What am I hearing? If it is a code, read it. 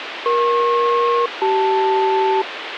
Aircraft SELCAL, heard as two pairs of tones, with radio hiss. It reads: EP-CL